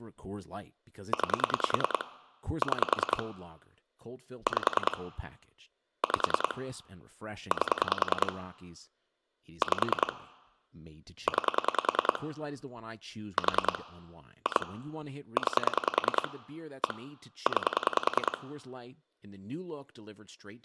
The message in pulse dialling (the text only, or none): 9 6 5 5 8 5 9 4 2 9 1 9